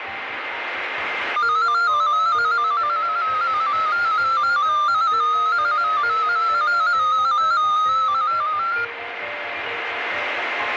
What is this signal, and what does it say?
Multi-tone FSK (Olivia or MFSK type), about 250 Hz wide, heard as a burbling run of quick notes, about 15.625 baud, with radio static and a steady whistle near 2090 Hz.